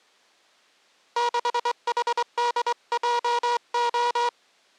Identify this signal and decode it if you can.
Morse code, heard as a buzzer, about 23 wpm. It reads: 6HDJO